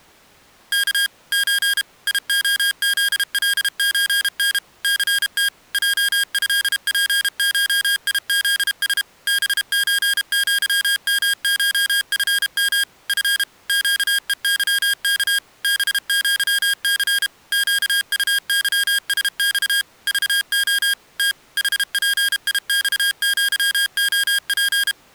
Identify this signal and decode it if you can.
Morse code (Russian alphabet), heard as electronic beeps, machine-sent, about 32 wpm, 1600 Hz. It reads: К Ч ИОЗЛЧН ЦТ ЙЭПШИЗС БЧЪМШФМ Ф ЩЕЫК БЪЦ ЩУЫСЬ ЖО Т ХПИЬЪОП